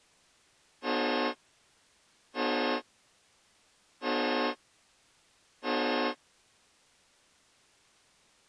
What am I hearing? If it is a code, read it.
Train horn signal, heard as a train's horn. 4 short. On North American railways: a request for a signal to be given or repeated.